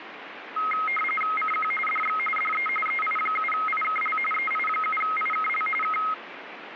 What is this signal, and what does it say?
RTTY (45.45 baud, 850 Hz shift), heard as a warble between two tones, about 1700 Hz centre, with radio static. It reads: CQ DX DE EI7IKL EI7IKL K